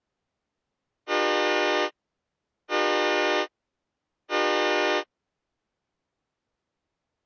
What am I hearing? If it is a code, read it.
Train horn signal, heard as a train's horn. 3 short. On North American railways: when stopped, the train will back up.